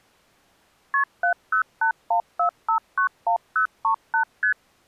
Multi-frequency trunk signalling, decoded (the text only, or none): KP 70814591038 ST